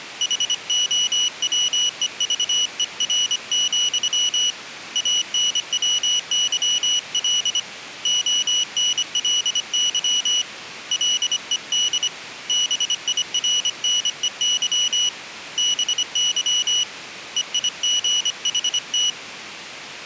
Morse code, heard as a high beeper, hand-sent with a paddle, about 25 wpm, 2950 Hz. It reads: HOWEVER, ANWYL ONLY LED BIRNEY BY EIGHT